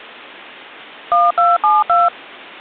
DTMF, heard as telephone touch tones, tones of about 190 ms. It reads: 1272